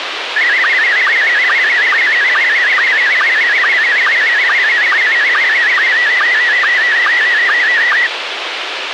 SSTV (slow-scan television), Scottie S1, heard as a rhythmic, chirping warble, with radio hiss.